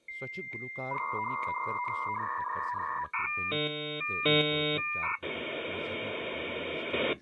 Dial-up modem handshake (V.34 or later), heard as a whistle, warbles, then hiss, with speech in Kashmiri.